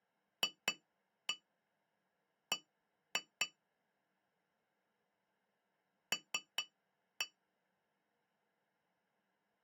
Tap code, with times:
0.4-3.5 FB
6.1-7.3 L

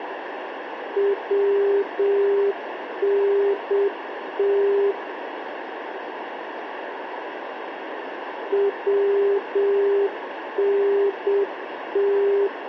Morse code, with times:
1.0-4.9 WNT
8.5-12.5 WNT

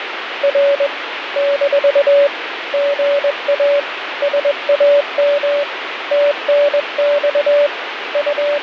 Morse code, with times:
0.4-0.9 R
1.4-2.3 -
2.7-3.8 GA
4.2-5.6 SAM
6.1-7.7 TNX
8.1-8.6 …

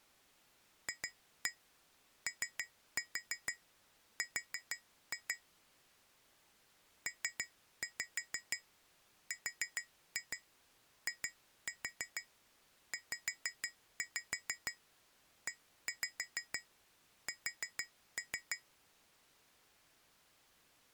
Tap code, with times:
0.9-5.3 FOR
7.1-18.6 PRIZES

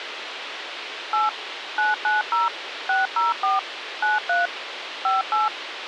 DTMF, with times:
1.1-1.3 8
1.8-2.5 990
2.9-3.6 604
4.0-4.5 93
5.0-5.5 58

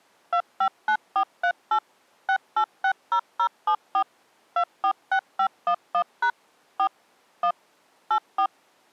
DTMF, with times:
0.3-1.8 259438
2.3-4.0 6860074
4.6-6.3 246511#
6.8-6.9 4
7.4-7.5 1
8.1-8.5 84

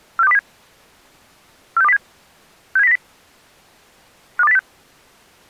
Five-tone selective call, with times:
0.2-0.4 46207
1.8-2.0 46207
2.8-3.0 67090
4.4-4.6 52806

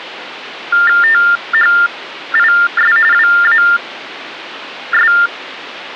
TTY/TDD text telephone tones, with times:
1.0-3.0 THIS
3.1-5.1 WAS

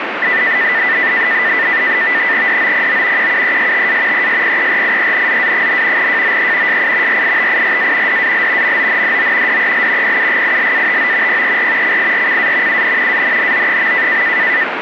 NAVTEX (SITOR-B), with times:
2.5-3.3 DOPO
3.2-4.3 QUESTA
4.1-6.1 ESPERIENZA,
6.0-6.8 JOE
6.7-7.2 SI
7.1-8.2 RITIRA
8.1-8.8 DAL
8.6-9.6 MONDO
9.5-10.2 DEL
10.0-11.4 PUGILATO
11.3-12.0 PER
11.8-12.8 CIRCA
12.7-13.2 UN
13.1-14.2 ANNO.

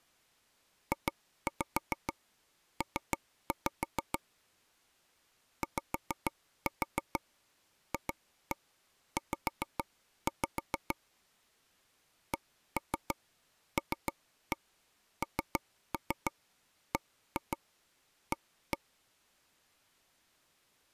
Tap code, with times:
0.9-4.2 JP
5.6-11.0 YFZ
12.3-18.8 CLNBA

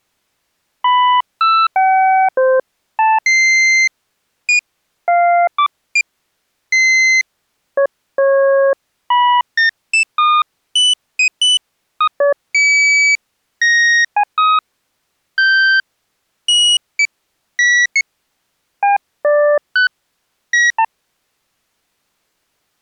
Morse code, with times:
none

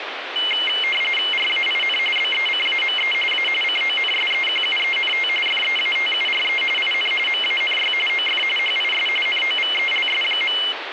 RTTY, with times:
1.3-2.0 RAIN
2.2-3.1 BECAME
3.3-3.5 A
3.6-5.3 CONSEQUENT
5.5-6.6 FEATURE
6.8-7.1 IN
7.3-7.9 MANY
8.1-8.4 OF
8.6-9.1 HIS
9.3-10.6 NOVELS.

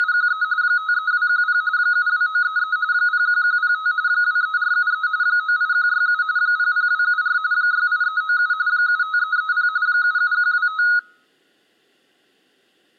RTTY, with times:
0.0-0.4 …
0.6-1.6 53210
1.8-2.8 72933
2.9-3.9 01105
4.1-5.1 23473
5.2-6.2 98167
6.4-7.4 00274
7.5-8.5 68397
8.7-9.7 75330
9.9-10.8 77125

